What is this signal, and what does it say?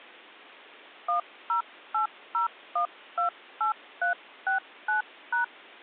DTMF, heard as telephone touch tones, dialled by hand, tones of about 120 ms. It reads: 1080128369#